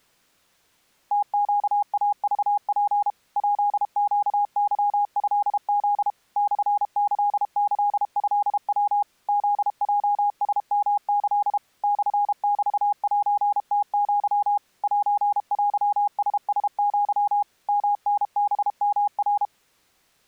Morse code (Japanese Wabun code), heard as a keyed tone, machine-sent, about 32 wpm, 820 Hz. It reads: ムネイクツ ヱネケトフ モキキトヤ フヲラヨキ モメセムア セテララア ヨタハヨナ